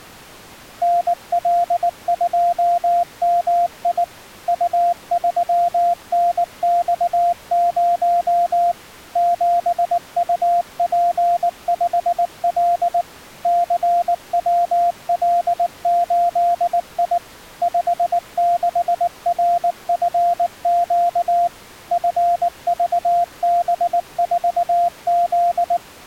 Morse code, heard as a keyed tone, machine-sent, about 19 wpm, 700 Hz. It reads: NL2MI U3NX0 7UP5L CWL8I 56RFQ FVB4Z